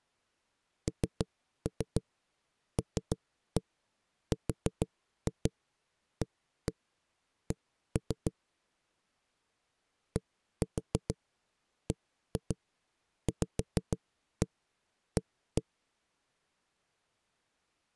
Tap code, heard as knocks on a wall, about 6 knocks a second. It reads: NLRAC DBVA